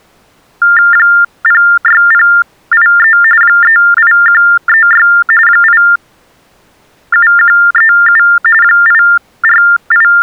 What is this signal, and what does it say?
TTY/TDD text telephone tones (45.45 baud Baudot), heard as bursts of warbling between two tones, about 400 Hz shift, 1600 Hz centre. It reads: 06083 38136 87137 …